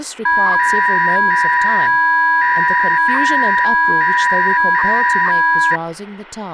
300-baud modem data (V.21 tones), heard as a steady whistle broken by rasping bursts, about 300 baud, 200 Hz shift, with speech in English.